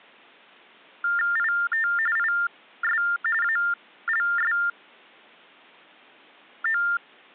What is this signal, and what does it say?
TTY/TDD text telephone tones (45.45 baud Baudot), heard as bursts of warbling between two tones, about 400 Hz shift, 1600 Hz centre. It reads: IT IS ALSO